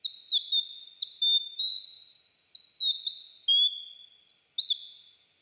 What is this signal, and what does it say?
Bird-like chirps, with room echo. There is no code.